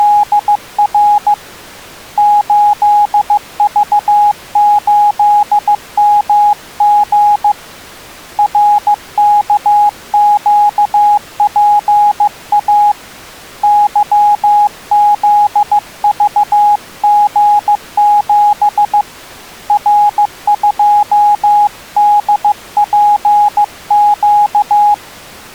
Morse code, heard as a keyed tone, hand-sent with a paddle, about 15 wpm, 830 Hz. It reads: … 8V8MG RKQPA YZVG7 R2DPQ